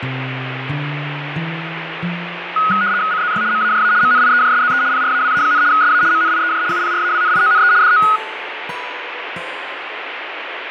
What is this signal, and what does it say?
RTTY (75 baud, 170 Hz shift), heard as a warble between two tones, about 1360 Hz centre, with radio static. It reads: CZY MAJA MNIEJSZE PRAWA, SA MNIEJ UPRAWNIONE DO